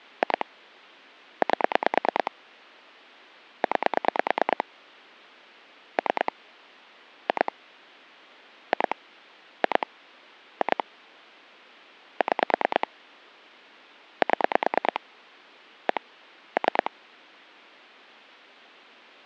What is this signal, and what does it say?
Pulse dialling, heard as clicks on a phone line, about 9 pulses a second. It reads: 2 8 9 3 2 2 2 2 6 7 1 3